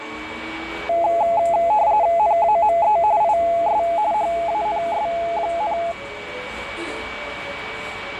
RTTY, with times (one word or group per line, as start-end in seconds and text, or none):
2.2-3.0 NAME
3.2-3.8 IS
4.1-5.8 HANS,